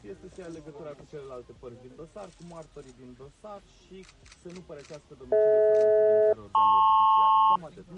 Aircraft SELCAL, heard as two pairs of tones. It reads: DH-LP